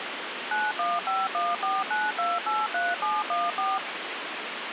DTMF, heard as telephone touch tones, dialled by machine, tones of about 200 ms, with phone line noise. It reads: 915149283714